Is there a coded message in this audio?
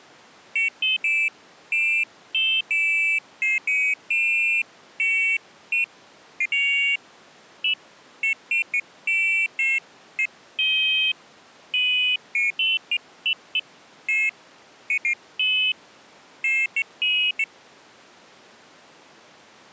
No, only pairs of high tones at irregular times.